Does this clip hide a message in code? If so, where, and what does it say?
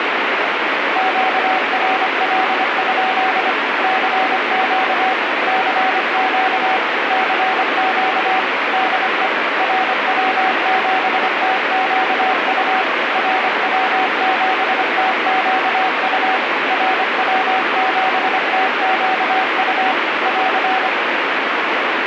Yes: Morse code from 0.9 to 20.9 s, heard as a keyed tone, machine-sent, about 25 wpm, 760 Hz, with heavy radio static. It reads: QRL? CQ CQ CQ DE RW7TQU RW7TQU RW7TQU <AR>